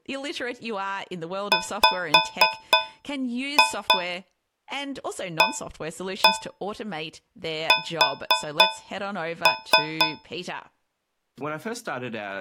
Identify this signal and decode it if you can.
Tap code, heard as taps on a metal pipe, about 3 knocks a second, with speech in English. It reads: WAS